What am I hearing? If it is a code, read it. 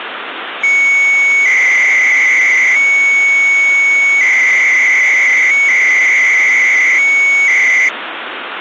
300-baud modem data (Bell 103 tones), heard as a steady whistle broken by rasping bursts, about 300 baud, 200 Hz shift, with phone line noise.